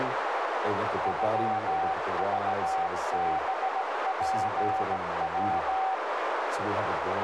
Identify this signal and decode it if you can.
Morse code (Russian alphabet), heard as a keyed tone, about 17 wpm, 760 Hz, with heavy radio static, a narrow filter and speech in English. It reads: ЮЖБПВ